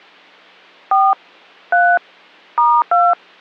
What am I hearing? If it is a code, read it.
DTMF, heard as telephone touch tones, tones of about 200 ms. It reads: 4 3 *2